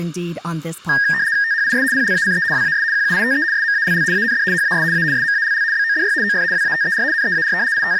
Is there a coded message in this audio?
Yes: RTTY (75 baud, 170 Hz shift) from 0.9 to 8.0 s, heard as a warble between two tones, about 1750 Hz centre. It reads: THIS PLACE WAS QUITE SMALL AND HAS A SMALL BODY OF WATER NEAR …